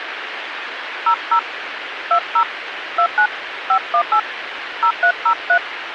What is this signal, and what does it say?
DTMF, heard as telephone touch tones, dialled by hand, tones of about 80 ms, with radio hiss. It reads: 00 20 29 518 0303